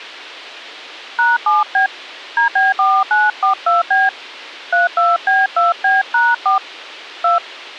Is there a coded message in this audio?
Yes: DTMF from 1.2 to 7.4 s, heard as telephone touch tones, dialled by hand, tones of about 180 ms. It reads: #7B DB4942B 32B2B#4 2